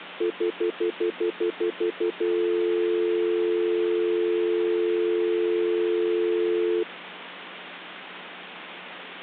Telephone call progress tone (North American plan), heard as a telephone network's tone, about 350, 440 Hz, 0.1 s on and 0.1 s off, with phone line noise. Stutter dial tone.